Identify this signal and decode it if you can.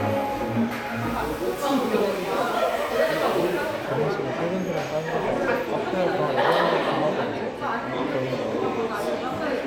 The noise of a crowd indoors. There is no code.